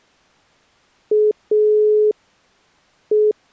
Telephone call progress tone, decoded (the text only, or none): dial tone